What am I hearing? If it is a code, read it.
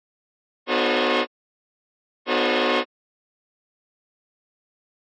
Train horn signal, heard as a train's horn. 2 short. On North American railways: a signal is acknowledged.